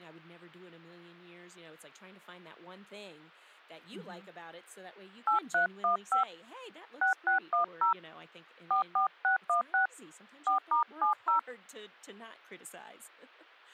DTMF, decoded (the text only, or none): 8315 6610 44616 4*70